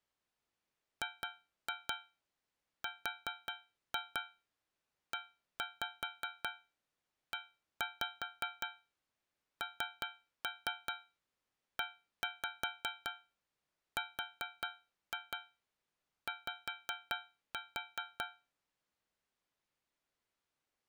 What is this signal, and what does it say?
Tap code, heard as taps on a metal pipe, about 5 knocks a second. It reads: GREENERY